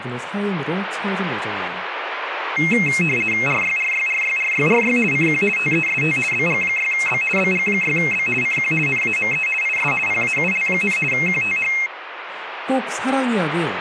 RTTY (50 baud, 450 Hz shift), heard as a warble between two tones, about 2350 Hz centre, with radio static and speech in Korean. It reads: RYRYRYRYRY CQ TEST BG6B BG6B CQ NAME IS PAUL, QTH